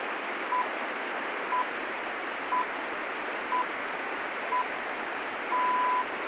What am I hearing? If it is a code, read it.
Radio time signal (six pips, as the Greenwich Time Signal), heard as pips, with radio static.